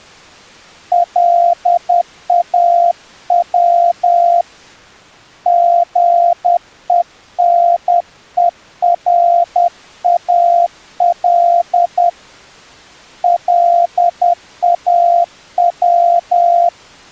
Morse code, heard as a keyed tone, hand-sent with a paddle, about 10 wpm, 690 Hz. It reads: LAW GENERAL LAW